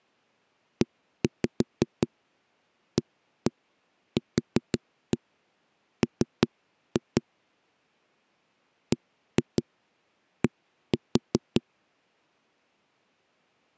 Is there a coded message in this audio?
Yes: tap code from 0.8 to 11.6 s, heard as knocks on a wall, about 5 knocks a second. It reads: EAQM BD